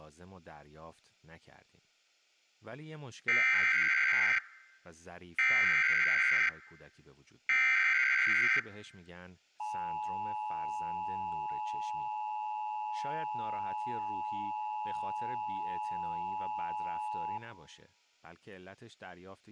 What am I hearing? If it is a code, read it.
Emergency Alert System (SAME) tones (header bursts, then the 853 and 960 Hz attention tone), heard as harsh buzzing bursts, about 520.83 baud, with speech in Persian.